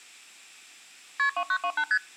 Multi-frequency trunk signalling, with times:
1.2-1.3 KP
1.4-1.8 2928
1.9-2.0 ST

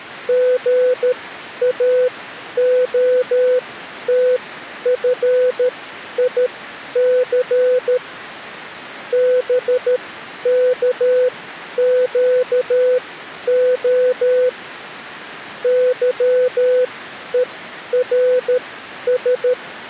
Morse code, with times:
0.3-8.0 GAOTFIC
9.1-14.5 BKQO
15.6-19.5 YERS

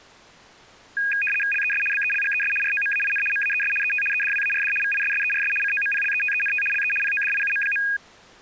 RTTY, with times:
1.5-1.8 LES
1.9-2.5 BELGES
2.6-3.2 ROMAIN
3.3-3.7 MAES
3.8-4.0 ET
4.1-4.7 EDWARD
4.8-5.5 VISSERS
5.6-6.6 COMPLETENT
6.7-6.9 LE
7.0-7.8 PODIUM.

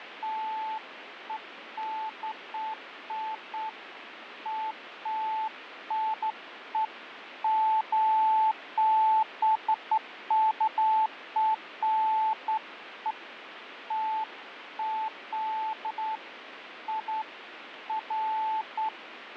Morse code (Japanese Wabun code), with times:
none

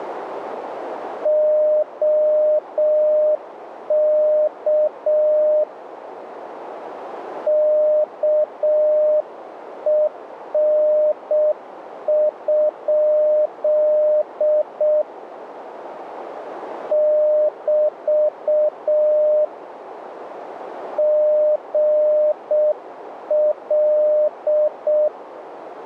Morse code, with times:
1.3-5.6 OK
7.5-15.0 KEN?
16.9-19.4 <BT>
21.0-25.1 GL

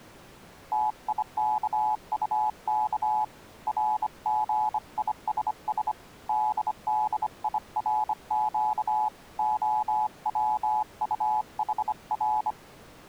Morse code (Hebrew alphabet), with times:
0.7-3.2 תיכטך
3.7-5.9 רגישש
6.3-9.1 דדירק
9.4-12.5 הצטחר

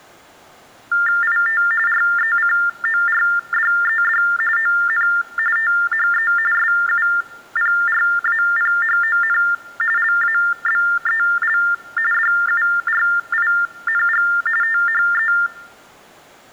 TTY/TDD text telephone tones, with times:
1.2-1.6 IT
1.9-4.2 RECORDED
4.6-5.1 ON
5.6-6.3 THE
6.5-9.4 SUPRAPHON
10.0-11.6 LABEL
12.1-14.3 DURING
14.6-15.3 THE

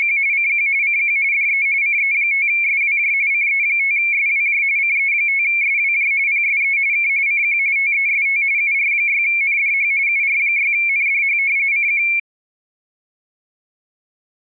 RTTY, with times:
0.0-0.2 …
0.3-0.7 CQ
0.8-1.2 CQ
1.3-1.7 DE
1.8-3.1 CE5SWJ
3.3-4.6 CE5SWJ
4.8-6.1 CE5SWJ
6.3-6.8 PSE
6.9-7.1 K
7.3-7.6 CQ
7.8-8.4 TEST
8.6-9.9 UR6NDH
10.1-11.4 UR6NDH
11.7-12.0 CQ

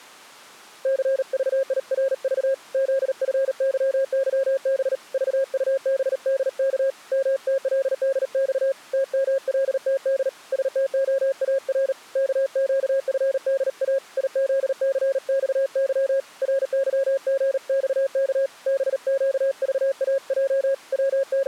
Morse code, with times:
0.9-2.5 CVIRV
2.7-5.0 ZFYYB
5.1-6.9 VUBDK
7.1-8.7 MTLDX
8.9-10.3 TMLTD
10.5-11.9 STOAR
12.2-14.0 KQFDA
14.2-16.2 IZCXY
16.4-18.5 RYGXK
18.7-20.7 BQVAJ
20.9-21.5 …

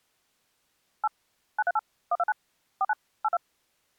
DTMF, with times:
1.0-1.1 8
1.6-1.8 938
2.1-2.3 129
2.8-2.9 49
3.2-3.4 82

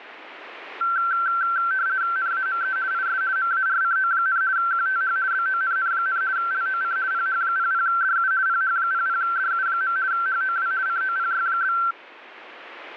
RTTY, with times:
2.2-2.8 NAME
2.9-3.2 IS
3.4-4.4 MARCO,
4.6-5.2 QTH
5.3-6.2 BONN,
6.4-7.0 LOC
7.1-8.3 PH00DU
8.5-10.0 PH00DU.
10.1-10.7 HOW
10.9-11.8 COPY?

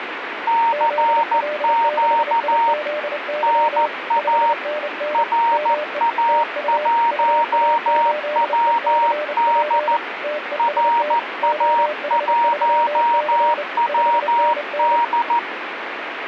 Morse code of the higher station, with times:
0.5-2.7 CQ
3.4-4.5 NA
5.1-10.0 RA1WD
10.6-15.4 RA1WD

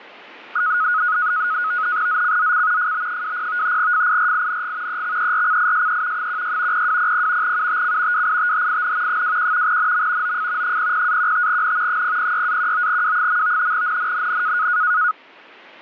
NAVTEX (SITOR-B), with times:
2.1-2.9 ZCZC
2.8-3.8 FB20
3.8-5.0 FIRING
4.9-6.3 EXERCISE
6.2-6.9 16
6.7-7.6 0200
7.4-8.3 UTC
8.1-9.2 WITHIN
9.1-9.8 21
9.7-10.4 NM
10.2-10.8 OF
10.6-12.0 00-15N
11.9-13.7 006-19W.
13.7-14.7 NNNN

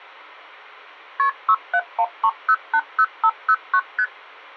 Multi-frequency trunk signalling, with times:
1.2-1.3 KP
1.5-3.8 6713080509
4.0-4.0 ST

